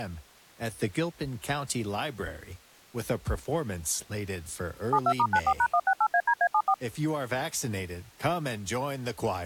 DTMF, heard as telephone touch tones, dialled by machine, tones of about 60 ms, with speech in English. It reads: 72*94#168ADA74